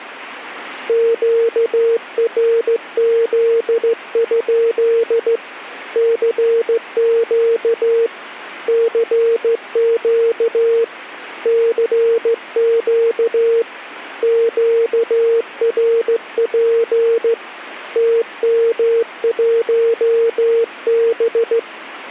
Morse code, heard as a keyed tone, hand-sent with a straight key, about 15 wpm, 460 Hz. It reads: QRZ? CQ CQ CQ QRP TM1B